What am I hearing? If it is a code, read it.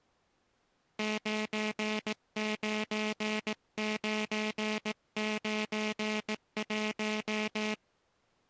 Morse code, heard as a buzzer, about 18 wpm. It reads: 99991